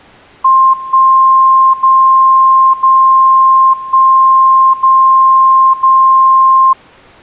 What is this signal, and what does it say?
Radio time signal (DCF77), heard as a tone whose level steps once a second, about 1060 Hz. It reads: 1 0 0 1 0 0